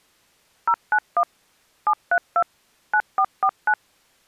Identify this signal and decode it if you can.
DTMF, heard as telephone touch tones, dialled by machine, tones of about 70 ms. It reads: 091 732 9449